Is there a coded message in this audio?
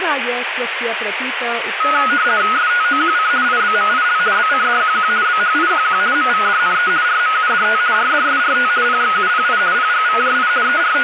Yes: RTTY (50 baud, 170 Hz shift) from 1.8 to 11.0 s, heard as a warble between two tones, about 1360 Hz centre, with radio static and speech in Sanskrit. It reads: STOQC IBMIL BCDQQ BHIQQ MVDNE RMUDT RDSRT PXUPI PGVJI …